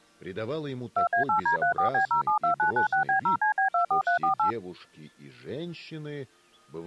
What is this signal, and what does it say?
DTMF, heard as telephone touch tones, dialled by machine, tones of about 110 ms. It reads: 2A8D34B072996B0CB24348